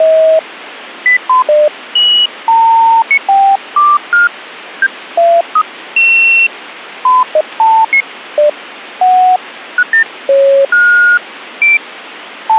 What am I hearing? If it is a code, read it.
Electronic bleeps of random pitch and length, with radio static. There is no code.